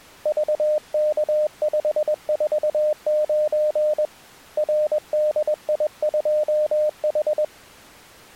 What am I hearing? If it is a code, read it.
Morse code, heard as a keyed tone, hand-sent with a paddle, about 21 wpm, 610 Hz. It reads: VK549 RDI2H